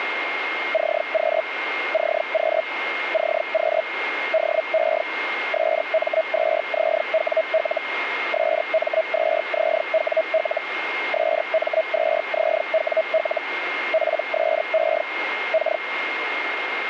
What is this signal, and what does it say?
Hellschreiber (Feld-Hell, 122.5 baud), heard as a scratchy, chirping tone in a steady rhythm, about 640 Hz, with radio static and a steady whistle near 2130 Hz. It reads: CQ CQ CQ DE SM2ZWL SM2ZWL SM2ZWL PSE K